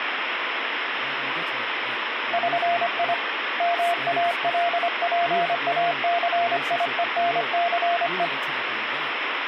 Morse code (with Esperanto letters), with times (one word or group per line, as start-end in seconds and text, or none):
2.3-3.1 ŜI
3.6-8.3 MALPACIENCE